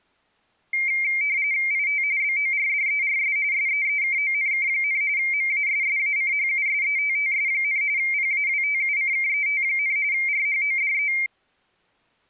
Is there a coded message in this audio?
Yes: RTTY (45.45 baud, 170 Hz shift) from 0.7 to 11.3 s, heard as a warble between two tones, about 2200 Hz centre. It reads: IT BORDERS SEEKONK, MASSACHUSETTS, PAWTUCKET, RHODE